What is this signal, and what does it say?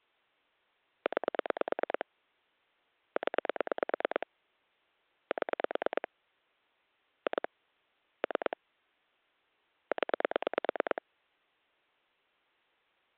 Pulse dialling, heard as clicks on a phone line, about 9 pulses a second. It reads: 9 0 7 2 3 0